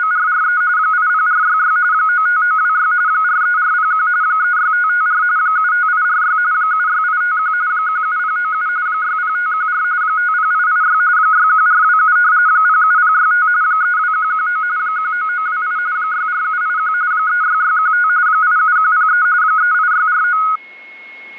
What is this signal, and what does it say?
RTTY (45.45 baud, 170 Hz shift), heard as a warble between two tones, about 1360 Hz centre, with a steady whistle near 2170 Hz. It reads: … 80466 95926 43401 36554 75846 76851 17097 60514 50886 61427 07065 32119 19928 64781 36615 87103 38649